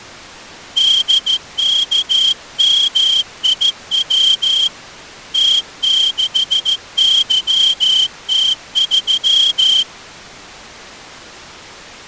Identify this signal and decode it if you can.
Morse code, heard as a whistle, hand-sent with a straight key, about 14 wpm. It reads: DKMIW T6YT3